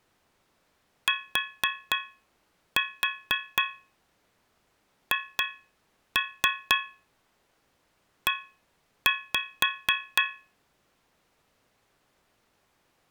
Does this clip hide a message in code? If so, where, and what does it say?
Yes: tap code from 1.1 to 10.5 s, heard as taps on a metal pipe, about 4 knocks a second. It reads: THE